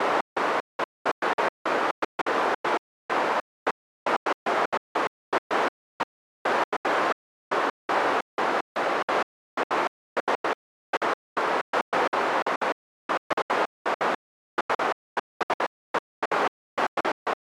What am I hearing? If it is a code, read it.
Bursts of noise. There is no code.